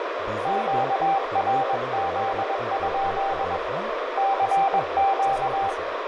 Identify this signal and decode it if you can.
Morse code, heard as a keyed tone, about 21 wpm, 780 Hz, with radio static, a narrow filter, room echo and speech in Assamese. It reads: QRZ? CQ